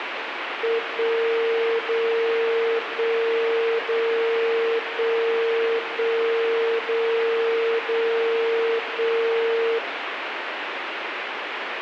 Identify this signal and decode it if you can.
Radio time signal (DCF77), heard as a tone whose level steps once a second, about 460 Hz, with radio static. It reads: 1 0 1 0 1 1 0 0 1